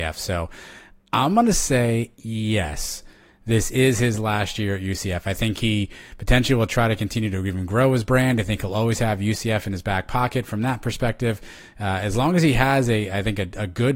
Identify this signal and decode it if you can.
Speech in English. There is no code.